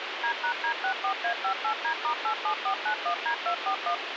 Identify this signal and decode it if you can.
DTMF, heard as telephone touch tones, dialled by machine, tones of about 90 ms, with radio hiss. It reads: D#D64A58D*87491D241